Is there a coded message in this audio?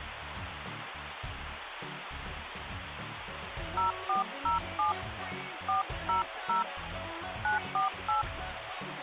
Yes: DTMF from 3.8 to 8.2 s, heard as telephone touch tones, dialled by hand, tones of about 130 ms, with phone line noise. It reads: 0407 400 948